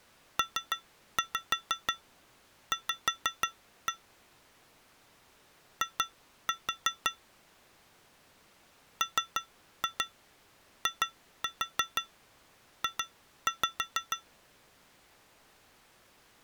Tap code, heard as taps on glass, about 6 knocks a second. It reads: PV I MIJ